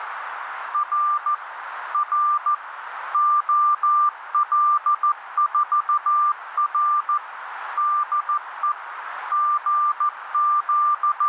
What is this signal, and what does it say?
Morse code, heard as a keyed tone, machine-sent, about 14 wpm, 1190 Hz, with radio static and a narrow filter. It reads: R R OL4R DE …